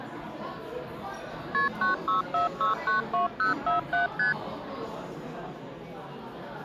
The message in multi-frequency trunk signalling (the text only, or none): KP 964692047 ST